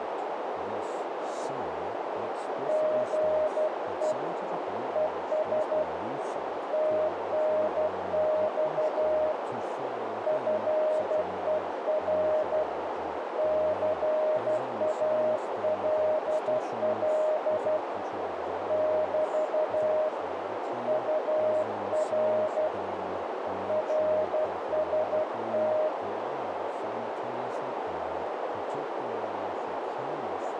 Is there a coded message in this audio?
Yes: Morse code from 2.6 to 25.9 s, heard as a keyed tone, hand-sent with a paddle, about 12 wpm, 620 Hz, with heavy radio static, a narrow filter and speech in English. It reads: GE ES TNX FER CALL <BT> UR RST